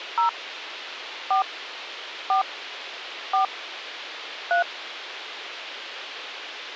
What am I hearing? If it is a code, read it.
DTMF, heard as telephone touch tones, dialled by hand, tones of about 120 ms, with radio hiss. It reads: 0 4 4 4 3